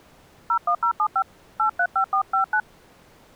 DTMF, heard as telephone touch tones, dialled by hand, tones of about 90 ms. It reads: 01075 835459